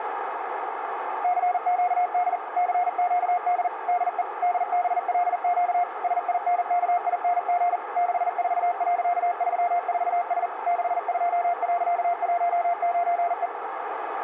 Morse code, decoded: CQD CQD DE DBLQ SINKING 64.34S 62.19E

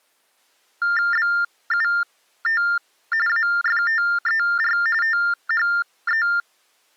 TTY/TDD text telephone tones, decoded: BUT AFTER THE

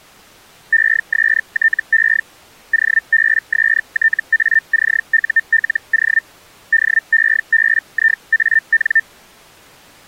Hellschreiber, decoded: ESTE OBSTACULO DEBIAN

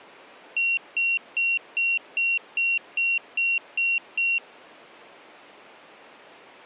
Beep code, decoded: 10 short

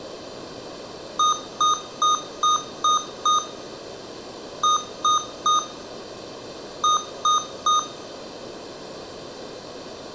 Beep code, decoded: 6-3-3

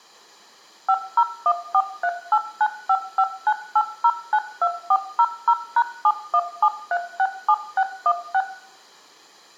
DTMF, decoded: 50143895598092400#717367616

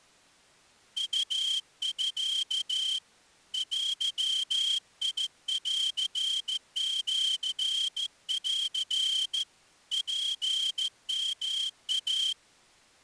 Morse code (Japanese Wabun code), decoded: ウミ デンシン ツヨイ

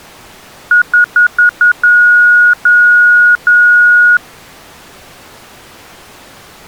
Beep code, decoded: 5 short, 3 long

